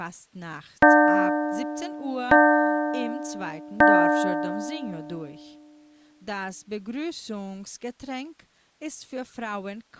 Clock strike, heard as a bell, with speech in German. 3. Three o'clock.